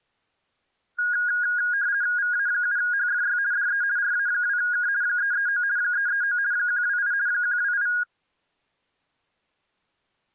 RTTY (50 baud, 170 Hz shift), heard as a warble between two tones, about 1550 Hz centre. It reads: VA7HFY DE RA2K 339 339 128 128